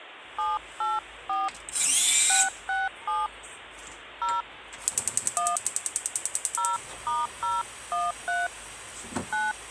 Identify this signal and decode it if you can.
DTMF, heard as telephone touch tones, dialled by hand, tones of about 190 ms, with phone line noise and kitchen noise. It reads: 784 667 0 1 0*013 9